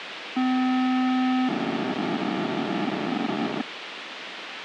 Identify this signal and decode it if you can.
POCSAG pager data (512 baud), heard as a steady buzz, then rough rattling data, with radio hiss.